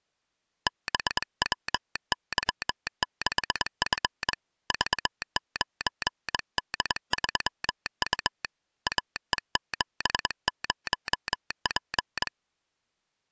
Morse code, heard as a telegraph sounder, hand-sent with a straight key, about 22 wpm. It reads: BWY6F V9D3U AE70P